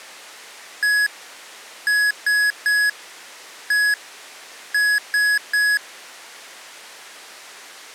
Beep code, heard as beeps from a small speaker, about 1700 Hz. 1-3-1-3. In Phoenix BIOS tables: keyboard controller test failure.